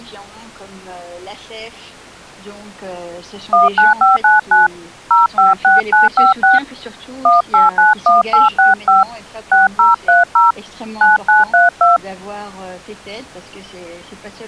DTMF, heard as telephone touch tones, dialled by hand, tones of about 160 ms. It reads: 19599 056956 1891865 6030 9932